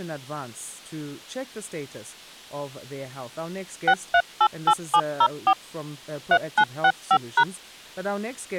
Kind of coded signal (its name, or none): DTMF